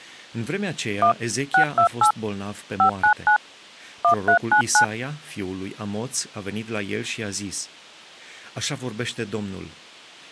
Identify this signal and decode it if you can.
DTMF, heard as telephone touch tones, dialled by machine, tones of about 100 ms, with speech in Romanian. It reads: 1 628 599 1399